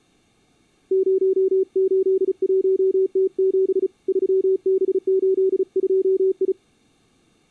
Morse code, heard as a keyed tone, hand-sent with a paddle, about 35 wpm, 380 Hz. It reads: 081T7 3B82I